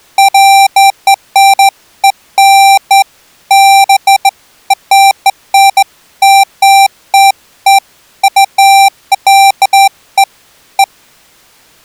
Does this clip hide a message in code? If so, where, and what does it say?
No, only beeps of irregular length.